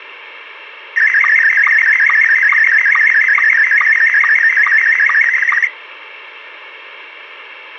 SSTV (slow-scan television), Scottie S1, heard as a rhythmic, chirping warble.